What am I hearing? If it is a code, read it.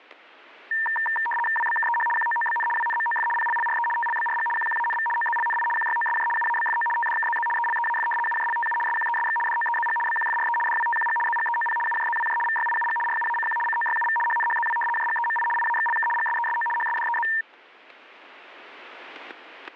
RTTY (75 baud, 850 Hz shift), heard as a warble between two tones, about 1370 Hz centre, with static crashes. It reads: WBKEH QOOBN WNMOF PLLRE TLBRG QQANV OZLNI QYOSJ UABFO TDKZZ ELEAF UJLTU SQESX DOEZG BQFRE DWTQG ZGEOP UJZWJ VYIUG RUACQ COYUV HNHZW JGEMI IAXLK GSESO HSDEZ